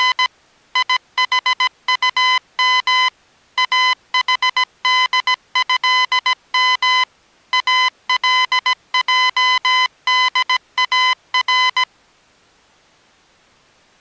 Morse code (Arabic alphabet), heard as electronic beeps, machine-sent, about 17 wpm, 1010 Hz. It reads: … يحطم احدهم الجدار